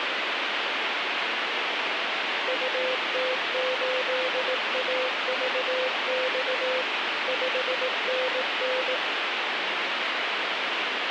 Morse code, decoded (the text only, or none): UT8AVX 5NN